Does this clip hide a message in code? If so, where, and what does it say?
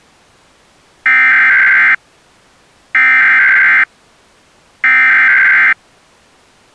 Yes: Emergency Alert System (SAME) tones (header bursts) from 1.1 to 5.7 s, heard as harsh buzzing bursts, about 520.83 baud.